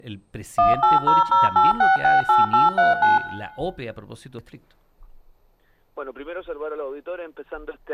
DTMF, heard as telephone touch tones, dialled by machine, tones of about 160 ms, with room echo. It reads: 18008668839